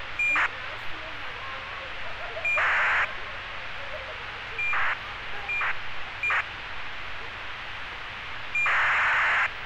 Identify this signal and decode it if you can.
ACARS aircraft data, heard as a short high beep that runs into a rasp, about 2400 baud, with radio hiss and street noise.